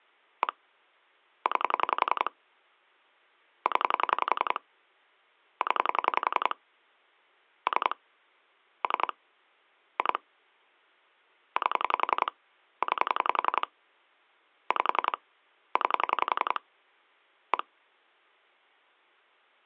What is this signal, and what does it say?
Pulse dialling, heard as clicks on a phone line, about 11 pulses a second. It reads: 1 9 0 0 3 3 2 8 9 5 9 1